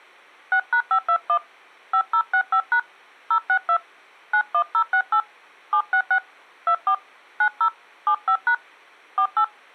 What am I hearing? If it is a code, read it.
DTMF, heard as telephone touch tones, dialled by hand, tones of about 80 ms. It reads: 6#521 5065# 062 91068 766 24 90 75# 48